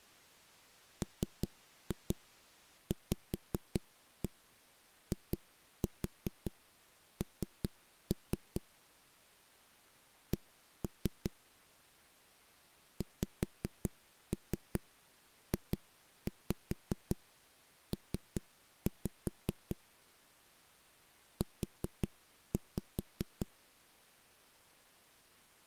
Tap code, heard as knocks on a wall, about 5 knocks a second. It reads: MVIN C XJP U